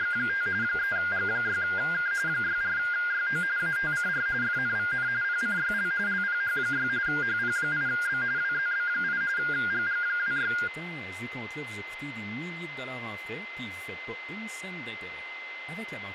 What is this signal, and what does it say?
RTTY (45.45 baud, 170 Hz shift), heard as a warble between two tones, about 1500 Hz centre, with radio static, a steady whistle near 2060 Hz and speech in French. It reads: … 3G6K 64YO ATCR FNVN PCYL LPH6 HP8B WZB8 GG26